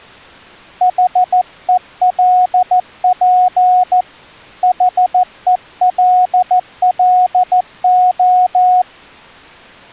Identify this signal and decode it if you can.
Morse code, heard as a keyed tone, hand-sent with a paddle, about 14 wpm, 730 Hz. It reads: HELP HELLO